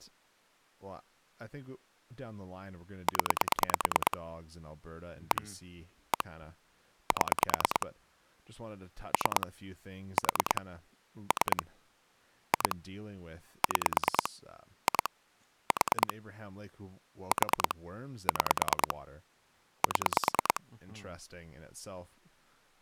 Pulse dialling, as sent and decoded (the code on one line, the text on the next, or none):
10 / 1 / 1 / 7 / 3 / 4 / 3 / 2 / 6 / 2 / 4 / 4 / 6 / 7
0 1 1 7 3 4 3 2 6 2 4 4 6 7